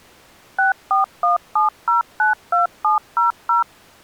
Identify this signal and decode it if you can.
DTMF, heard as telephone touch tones, dialled by machine, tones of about 140 ms. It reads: 6417092700